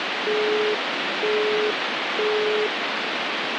Telephone call progress tone (single-tone plan, as in Europe, Japan and elsewhere), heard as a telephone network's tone, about 420 Hz, 0.48 s on and 0.48 s off, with phone line noise. Busy tone.